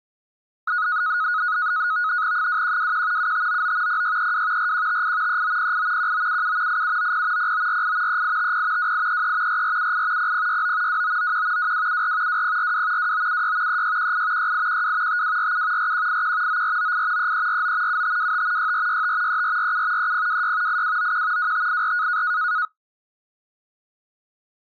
NAVTEX (SITOR-B), 100 baud, 170 Hz shift, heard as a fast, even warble, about 1360 Hz centre. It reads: 2121 7599 0632 4158 3908 1977 8790 0948 3850 2833 4478 0069 2991 2274 2042 2976 3618 6812 5247 4181 9498 3349 7525 6465 3447 3026 8291 2584